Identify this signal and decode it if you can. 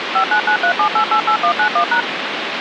DTMF, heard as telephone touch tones, dialled by machine, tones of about 90 ms, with phone line noise. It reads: 59937888191#